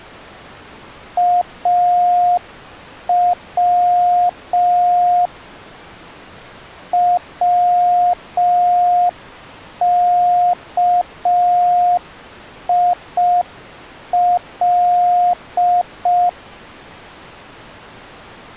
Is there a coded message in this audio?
Yes: Morse code (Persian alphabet) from 1.1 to 16.4 s, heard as a keyed tone, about 5 wpm, 710 Hz. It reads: او وکیل